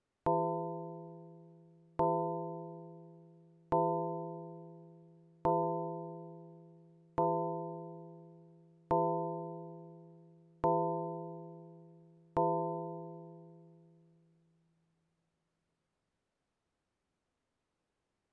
Clock strike, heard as a bell. 8. Eight o'clock.